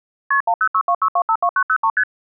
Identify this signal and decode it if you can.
Multi-frequency trunk signalling (R1, as on North American trunks), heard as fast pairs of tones, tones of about 70 ms. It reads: KP 10626252903 ST